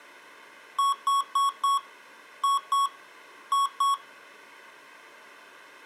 Beep code, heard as beeps from a small speaker, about 1110 Hz. 4-2-2. In Phoenix BIOS tables: shutdown test failure.